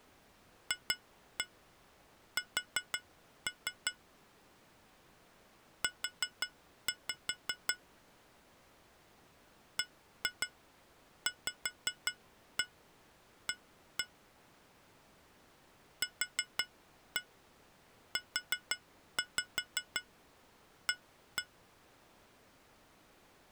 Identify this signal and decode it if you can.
Tap code, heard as taps on glass, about 5 knocks a second. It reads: FS U BVA QUA